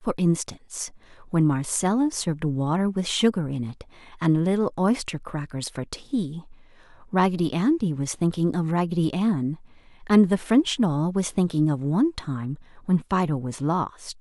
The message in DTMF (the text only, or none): none